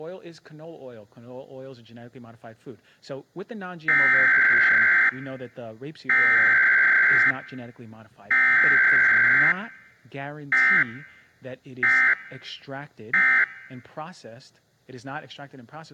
Emergency Alert System (SAME) tones (header bursts, then end-of-message bursts), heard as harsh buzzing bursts, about 520.83 baud, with speech in English.